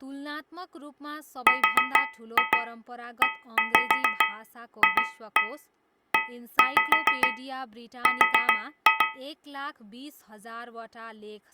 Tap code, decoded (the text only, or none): REFER